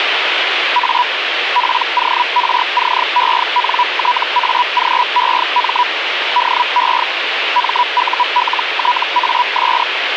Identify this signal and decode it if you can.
Hellschreiber (Feld-Hell, 122.5 baud), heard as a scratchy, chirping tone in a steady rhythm, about 980 Hz, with radio static. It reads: A PORCENTAGEM DE MULTAS